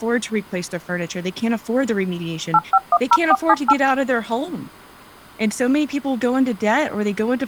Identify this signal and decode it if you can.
DTMF, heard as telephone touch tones, dialled by machine, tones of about 50 ms, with speech in English. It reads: 8510478